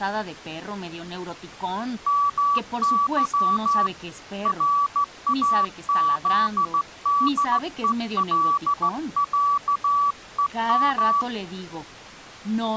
Morse code (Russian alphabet), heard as a keyed tone, hand-sent with a straight key, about 15 wpm, 1150 Hz, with speech in Spanish. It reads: МЫ РАЗДЕЛЯЕМ